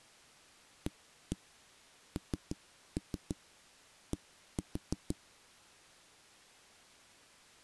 Tap code, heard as knocks on a wall, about 6 knocks a second. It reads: AND